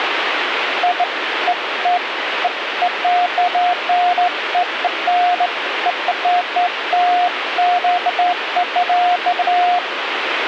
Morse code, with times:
none

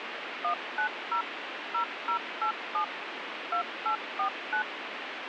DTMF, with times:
0.4-1.2 190
1.7-2.8 0087
3.5-4.6 2849

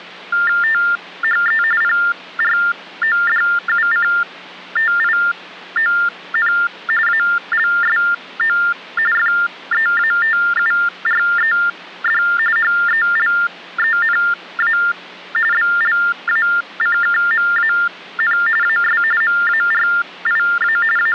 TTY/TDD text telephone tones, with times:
0.6-1.6 THE
1.8-6.5 PRODUCTION
7.1-8.6 ALSO
9.1-12.2 FEATURED
12.6-14.8 HELENA
15.5-18.4 BLACKMAN
18.6-19.0 AS
19.2-20.8 MARIA
21.0-21.1 …

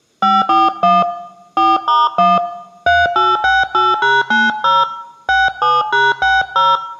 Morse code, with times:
none

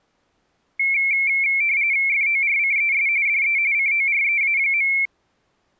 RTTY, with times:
2.1-3.1 FORCES
3.3-3.6 DE
3.7-4.9 COREA.

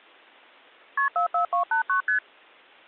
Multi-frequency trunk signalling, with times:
1.0-1.1 KP
1.2-2.0 44289
2.1-2.2 ST

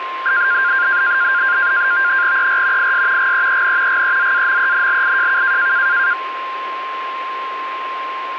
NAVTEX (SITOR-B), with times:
2.4-2.9 ER
2.8-3.3 IS
3.2-4.0 GEEN
3.9-5.7 GEZAMENLIJK

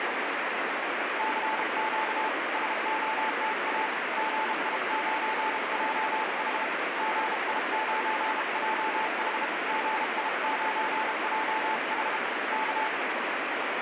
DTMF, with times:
none

